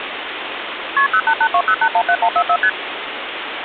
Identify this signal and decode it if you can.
Multi-frequency trunk signalling (R1, as on North American trunks), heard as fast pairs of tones, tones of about 70 ms, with phone line noise. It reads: KP 08820817144 ST